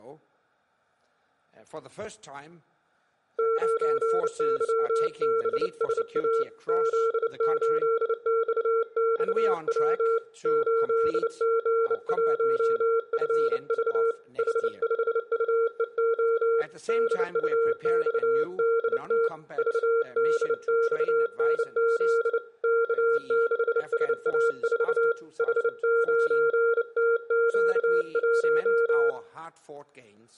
Morse code, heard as a keyed tone, hand-sent with a bug key, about 29 wpm, 460 Hz, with room echo. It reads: 9YBSA Z8XXW 8G1FV H5UEO DUXDT VDXNZ K6SA4 H9TQ1